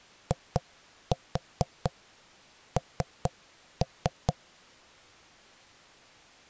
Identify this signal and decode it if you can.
Tap code, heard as knocks on wood, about 4 knocks a second. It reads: IN